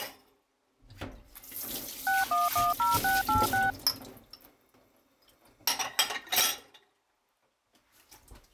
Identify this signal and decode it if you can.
DTMF, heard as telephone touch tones, dialled by machine, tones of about 170 ms, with kitchen noise. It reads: 6110686